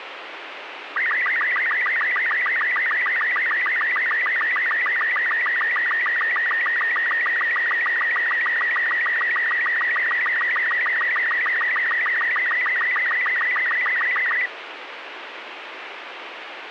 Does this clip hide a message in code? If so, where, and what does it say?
Yes: SSTV (slow-scan television), Robot 36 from 1.0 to 14.5 s, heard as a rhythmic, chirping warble, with radio hiss.